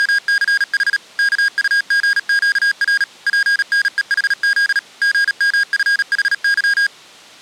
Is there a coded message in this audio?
Yes: Morse code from 0.0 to 6.9 s, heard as electronic beeps, machine-sent, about 37 wpm, 1650 Hz. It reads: … KUGQR PNEHZ GMFHY